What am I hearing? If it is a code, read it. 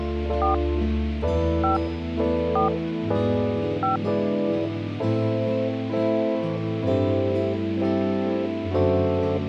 DTMF, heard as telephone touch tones, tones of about 130 ms. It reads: 4 5 4 5